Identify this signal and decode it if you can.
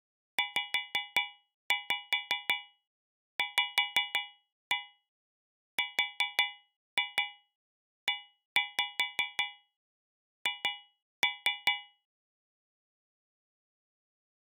Tap code, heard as taps on a metal pipe, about 5 knocks a second. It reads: ZVREH